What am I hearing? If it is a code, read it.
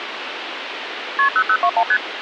Multi-frequency trunk signalling (R1, as on North American trunks), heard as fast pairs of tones, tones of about 70 ms, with phone line noise. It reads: KP 0021 ST